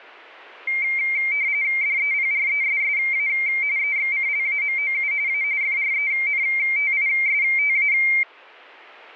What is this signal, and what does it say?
RTTY (45.45 baud, 170 Hz shift), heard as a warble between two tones, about 2200 Hz centre. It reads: DEPRESSA EXCLAMOU A FRENTISTA